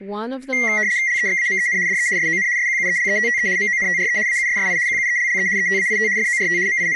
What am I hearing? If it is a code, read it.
RTTY (75 baud, 170 Hz shift), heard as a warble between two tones, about 2000 Hz centre, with speech in English. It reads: LEXAMEN DE SON SQUELETTE MONTRE AUSSI QUELLE ETAIT FORT …